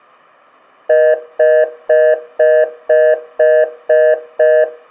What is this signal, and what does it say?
Telephone call progress tone (North American plan), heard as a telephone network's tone, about 480, 620 Hz, 0.25 s on and 0.25 s off, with room echo. Congestion tone.